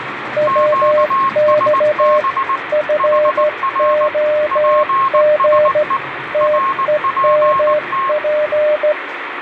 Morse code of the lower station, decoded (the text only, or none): WX FOG TEMP